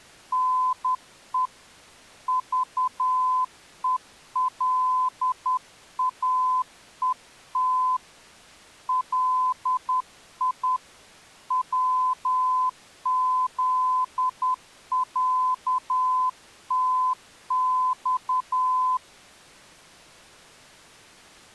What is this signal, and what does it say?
Morse code (Russian alphabet), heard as a keyed tone, hand-sent with a straight key, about 10 wpm, 1020 Hz. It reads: НЕ ЖЕЛАЕТ ЛИ ВЗЯТЬ